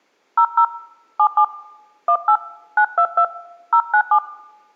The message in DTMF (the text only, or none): 00 77 18 922 097